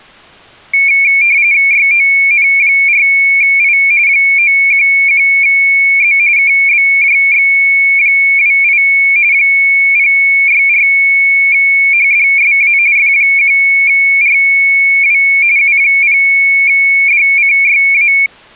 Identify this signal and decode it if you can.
RTTY (45.45 baud, 170 Hz shift), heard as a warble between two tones, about 2300 Hz centre. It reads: YON4I 911Z KBJX28 064HDSA F1RW U0DCYA